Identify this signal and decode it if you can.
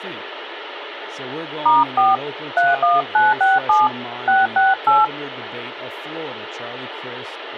DTMF, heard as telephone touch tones, dialled by hand, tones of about 180 ms, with phone line noise and speech in English. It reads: *4 31967 668